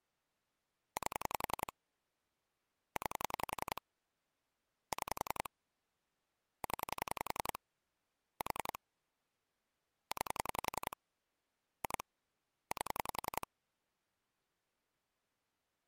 Pulse dialling, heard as clicks on a phone line, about 11 pulses a second. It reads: 8 9 6 0 4 9 2 8